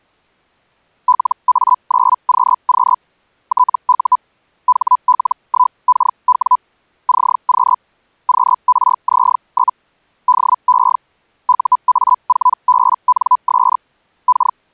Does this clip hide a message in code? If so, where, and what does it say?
Yes: Hellschreiber (Feld-Hell, 122.5 baud) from 1.1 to 14.6 s, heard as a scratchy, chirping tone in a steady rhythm, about 1000 Hz. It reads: LA9QQ TU HL1KW CQ QRZ? DE UA4BNS K